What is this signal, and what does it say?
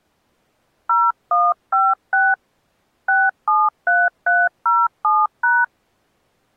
DTMF, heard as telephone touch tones, dialled by hand, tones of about 210 ms. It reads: 0156 673307#